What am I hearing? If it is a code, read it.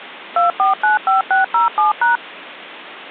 DTMF, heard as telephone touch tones, dialled by machine, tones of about 140 ms. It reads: 2495607#